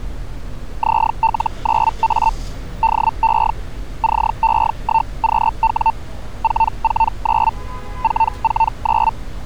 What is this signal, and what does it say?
Hellschreiber (Feld-Hell, 122.5 baud), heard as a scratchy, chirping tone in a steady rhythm, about 900 Hz, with street noise. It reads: ZL9A DE CE1QW 449 449